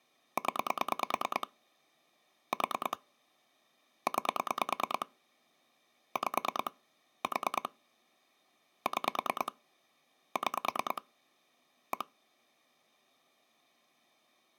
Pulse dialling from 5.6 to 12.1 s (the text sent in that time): 5 4 6 6 1